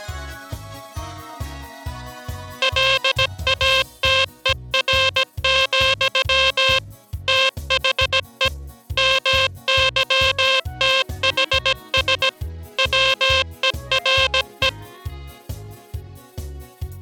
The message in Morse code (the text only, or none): LATER, THE MYTHS WERE